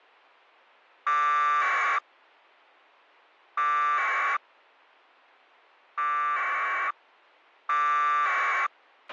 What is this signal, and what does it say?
Packet radio (AX.25, as in APRS), 1200 baud, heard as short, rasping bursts, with a squelch burst at the end.